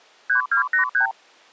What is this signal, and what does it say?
Multi-frequency trunk signalling (R2, with the far end's replies), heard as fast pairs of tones, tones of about 110 ms. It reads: 3283